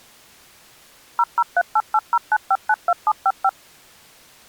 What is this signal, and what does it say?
DTMF, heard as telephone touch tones, dialled by machine, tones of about 50 ms. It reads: 0038809592755